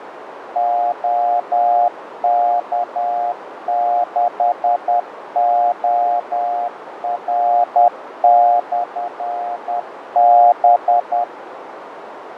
Morse code, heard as a keyed tone, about 10 wpm, 710 Hz, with radio static, fading and a narrow filter. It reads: OK6OR/B